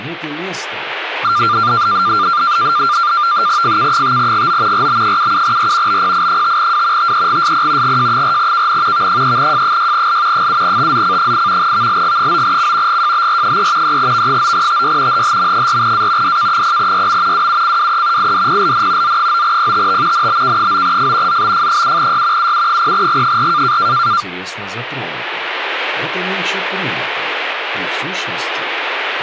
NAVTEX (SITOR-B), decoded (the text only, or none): FK5GO RB77R BPI5W TEGSP GJ4KN V3J6L 7TZC8 VLG9C GJBR3 3V9TY HHM4A DK0YM WUCWE IDPLN Z9PTT NBK9F ZBF7Y UU0G4